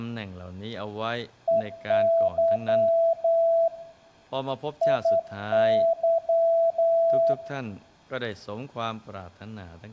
Morse code, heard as a keyed tone, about 10 wpm, 660 Hz, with room echo and speech in Thai. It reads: EY IY